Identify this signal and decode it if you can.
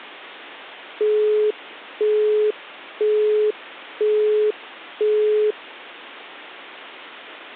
Telephone call progress tone (single-tone plan, as in Europe, Japan and elsewhere), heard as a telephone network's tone, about 420 Hz, 0.5 s on and 0.5 s off. Busy tone.